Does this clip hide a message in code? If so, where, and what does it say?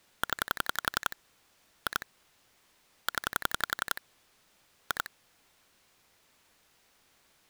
Yes: pulse dialling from 0.2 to 5.1 s, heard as clicks on a phone line, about 11 pulses a second. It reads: 0 2 0 2